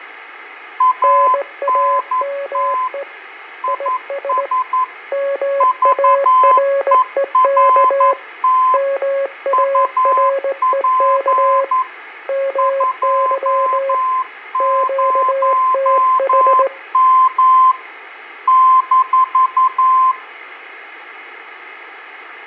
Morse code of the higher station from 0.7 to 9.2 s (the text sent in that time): ANT IS VERT